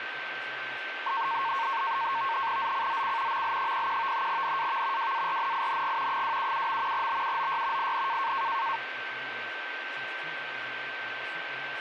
NAVTEX (SITOR-B), 100 baud, 170 Hz shift, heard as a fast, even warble, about 1000 Hz centre, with radio static, a steady whistle near 1550 Hz and speech in English. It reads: ZCZC ML01 NAV WARNING 277. BUOY IN